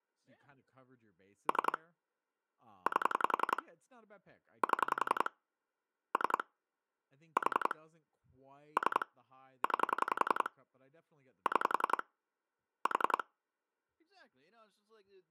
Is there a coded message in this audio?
Yes: pulse dialling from 1.5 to 13.2 s, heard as clicks on a phone line, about 11 pulses a second, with speech in English. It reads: 3 8 7 3 4 3 9 6 4